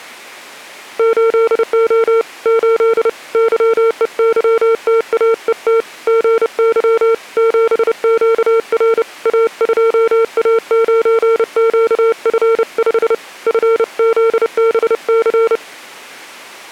Morse code, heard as a keyed tone, hand-sent with a paddle, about 30 wpm, 450 Hz. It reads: 8O 8 YEYTAET GY 7QR A2A9QF5 FZBC